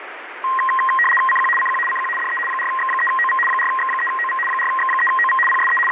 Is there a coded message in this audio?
Yes: RTTY (75 baud, 850 Hz shift) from 0.4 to 5.9 s, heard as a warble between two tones, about 1480 Hz centre, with radio static. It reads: CQ CQ CQ DE 4X3OV 4X3OV 4X3OV PSE …